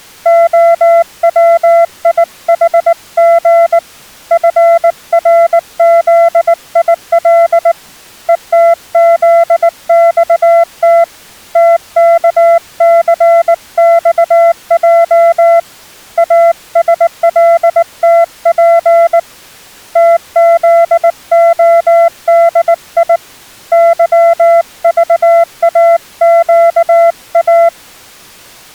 Morse code, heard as a keyed tone, hand-sent with a paddle, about 19 wpm, 680 Hz. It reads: OWIHG FRZIL ETZXT TKCXJ ASLTP TZODI YVAQA